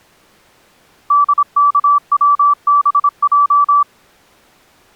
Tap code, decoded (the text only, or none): none